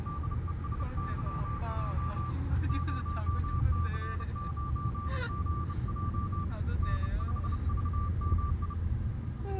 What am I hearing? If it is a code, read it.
Morse code, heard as a keyed tone, hand-sent with a bug key, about 30 wpm, 1170 Hz, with the noise inside a car. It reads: DESYJ 0C9GJ N5VMI